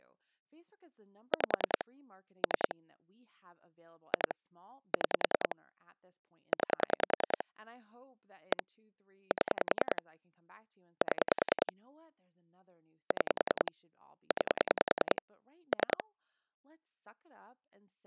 Pulse dialling, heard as clicks on a phone line, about 10 pulses a second, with speech in English. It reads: 5 3 2 6 9 1 7 7 6 9 3